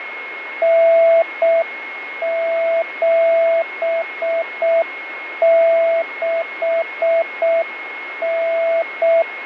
Morse code (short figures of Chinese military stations), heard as a keyed tone, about 6 wpm, 660 Hz, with radio static, fading and a steady whistle near 2160 Hz. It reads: 9769